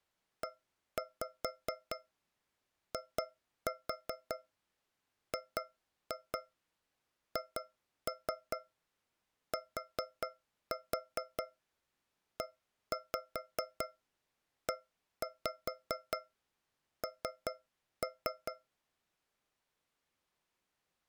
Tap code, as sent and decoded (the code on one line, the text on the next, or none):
1-5 2-4 2-2 2-3 4-4 1-5 1-5 3-3
EIGHTEEN